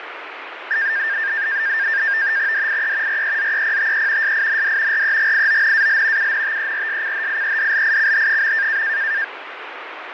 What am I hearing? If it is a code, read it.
NAVTEX (SITOR-B), 100 baud, 170 Hz shift, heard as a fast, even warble, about 1700 Hz centre, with radio static and fading. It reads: DIE REZEPTE SIND REGIONAL UNTERSCHIEDLICH.